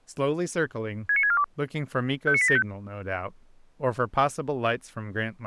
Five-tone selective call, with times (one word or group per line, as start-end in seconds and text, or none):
1.1-1.4 69642
2.3-2.6 59875